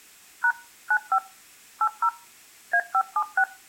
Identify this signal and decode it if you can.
DTMF, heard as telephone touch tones, dialled by machine, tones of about 70 ms. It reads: # 95 80 A576